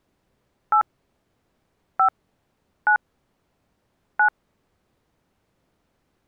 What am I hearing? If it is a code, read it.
DTMF, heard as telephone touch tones, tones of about 90 ms. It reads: 8 5 9 9